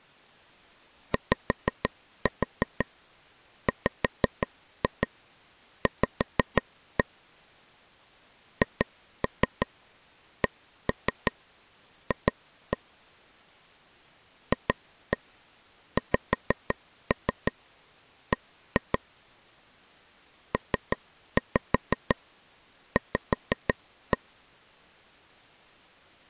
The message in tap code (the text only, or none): YWV HCF FXB PV